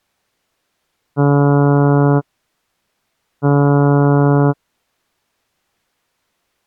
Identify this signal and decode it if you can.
Ship horn signal, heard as a ship's horn, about 140 Hz. 2 short. At sea: I am altering course to port.